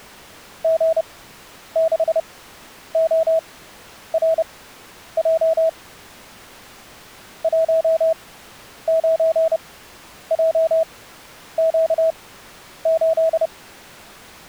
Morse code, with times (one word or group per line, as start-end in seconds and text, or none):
0.6-5.7 G6ORJ
7.4-13.5 19JQ8